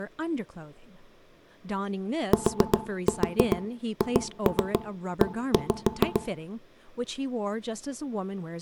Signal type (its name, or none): tap code